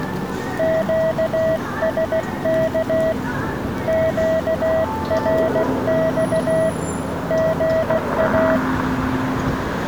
Morse code, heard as a keyed tone, hand-sent with a paddle, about 16 wpm, 640 Hz, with street noise. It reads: QSK QRX GA